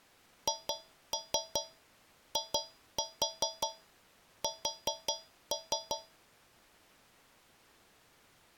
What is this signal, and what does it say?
Tap code, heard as taps on a metal pipe, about 5 knocks a second. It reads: HIS